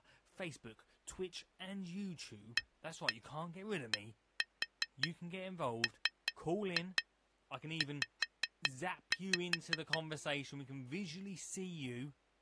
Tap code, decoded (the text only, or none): ADMZ